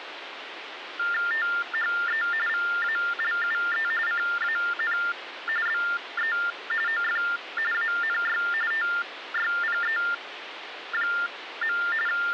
TTY/TDD text telephone tones (45.45 baud Baudot), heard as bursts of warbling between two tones, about 400 Hz shift, 1600 Hz centre, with phone line noise. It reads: THE VALUE CAN BE OF ANY TYPE. …